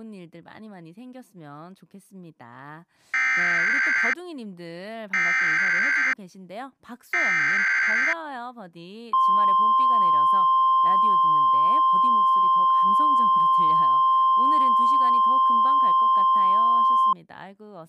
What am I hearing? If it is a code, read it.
Emergency Alert System (SAME) tones (header bursts, then the 1050 Hz attention tone), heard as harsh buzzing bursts, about 520.83 baud, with speech in Korean.